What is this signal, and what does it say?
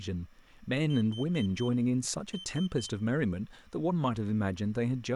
Beep code, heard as a piezo beeper, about 3100 Hz, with room echo and speech in English. 4-3.